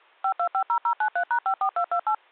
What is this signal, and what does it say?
DTMF, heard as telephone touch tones, dialled by machine, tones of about 80 ms. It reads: 5250093#54228